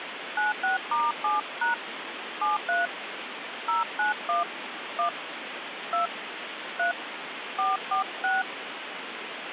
DTMF, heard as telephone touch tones, dialled by hand, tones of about 150 ms, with phone line noise. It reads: 96*7# 73 091 1 2 3 446